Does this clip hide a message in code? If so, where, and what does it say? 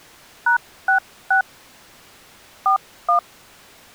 Yes: DTMF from 0.5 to 3.2 s, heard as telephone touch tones, dialled by hand, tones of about 110 ms. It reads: #66 41